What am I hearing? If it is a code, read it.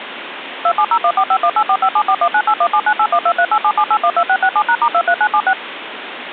DTMF, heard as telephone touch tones, dialled by machine, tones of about 70 ms, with phone line noise. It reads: 2701451845741981798123877812667#*23976